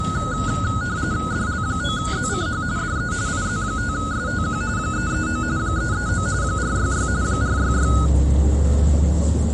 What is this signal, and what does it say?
RTTY (45.45 baud, 170 Hz shift), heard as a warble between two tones, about 1360 Hz centre, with the noise inside a bus. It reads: DL9ZCH DE IZ5STQ 339 339 466 466